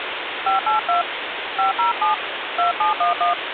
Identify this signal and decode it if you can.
DTMF, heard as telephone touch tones, dialled by hand, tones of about 130 ms, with phone line noise. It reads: 582 507 2711